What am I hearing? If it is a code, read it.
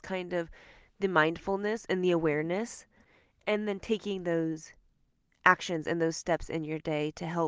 Speech in English. There is no code.